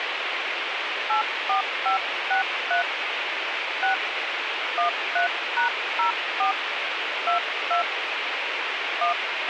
DTMF, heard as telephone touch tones, dialled by hand, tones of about 120 ms, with radio hiss and a squelch burst at the end. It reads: 84563 6 13#04 22 1